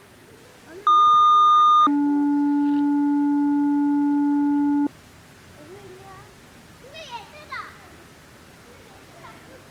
Two-tone page, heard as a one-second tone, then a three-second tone, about 1220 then 290 Hz, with the noise of a residential street.